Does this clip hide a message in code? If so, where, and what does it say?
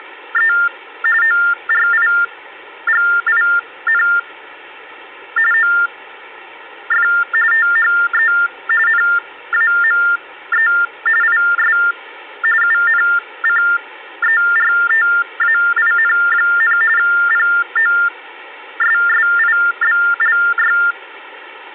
Yes: TTY/TDD text telephone tones (45.45 baud Baudot) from 0.0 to 20.9 s, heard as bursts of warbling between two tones, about 400 Hz shift, 1600 Hz centre, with phone line noise. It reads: … ORIGIN OF THE NAME IS UNCERTAIN, POSSIBLY